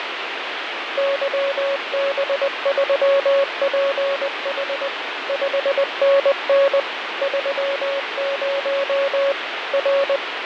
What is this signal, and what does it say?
Morse code, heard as a keyed tone, machine-sent, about 20 wpm, 550 Hz, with radio static and fading. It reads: YB3PH 5NN 30 R